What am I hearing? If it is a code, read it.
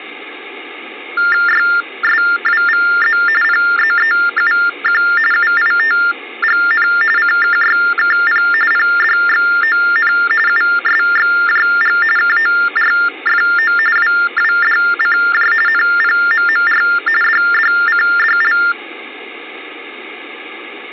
TTY/TDD text telephone tones (45.45 baud Baudot), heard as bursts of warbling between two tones, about 400 Hz shift, 1600 Hz centre. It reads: YSWVZ PZEUQ UITGN CKYKP PDXON USXJG KORFO WWDCJ NPMMR DDCDL